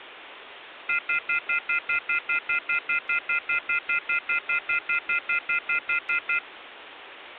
Telephone call progress tone (North American plan), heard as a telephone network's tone, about 1400, 2050, 2450, 2600 Hz, 0.1 s on and 0.1 s off, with phone line noise. Off-hook warning tone.